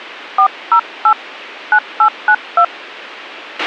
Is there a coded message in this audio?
Yes: DTMF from 0.4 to 2.6 s, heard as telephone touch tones, dialled by hand, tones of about 70 ms, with a squelch burst at the end. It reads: 408 9892